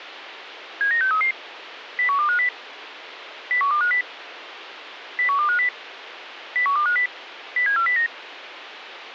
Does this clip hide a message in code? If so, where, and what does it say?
Yes: five-tone selective call (CCIR) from 0.8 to 8.1 s, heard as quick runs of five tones, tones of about 100 ms, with radio hiss. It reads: 79633 01250 01250 01250 01250 07409